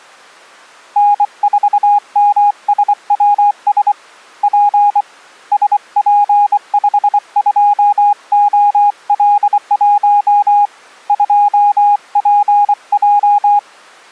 Morse code, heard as a keyed tone, hand-sent with a bug key, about 24 wpm, 820 Hz. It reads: N4MSWS P SP52OL1 2PJ